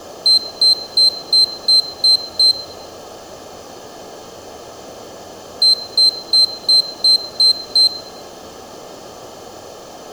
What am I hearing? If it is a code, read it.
Beep code, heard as a piezo beeper, played twice, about 4100 Hz, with room echo. 7 short. In AMI BIOS tables: virtual mode exception error; in Dell tables: processor failure.